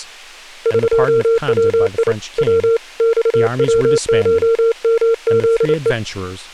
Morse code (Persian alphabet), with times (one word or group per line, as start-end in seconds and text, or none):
0.7-2.1 قوی
2.4-2.8 و
3.0-5.9 خوشمزه